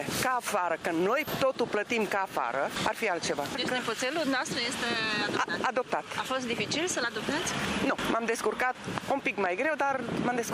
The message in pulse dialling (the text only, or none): none